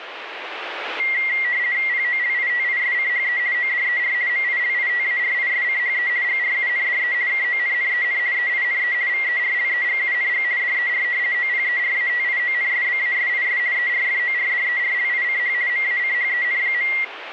RTTY (50 baud, 170 Hz shift), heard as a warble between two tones, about 2050 Hz centre, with radio static. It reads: POLITISCHE ODER MILITARISCHE GRUNDE KONNEN EINE VERLEGUNG DER OPERATIONSBASIS ERFORDERLICH MACHEN.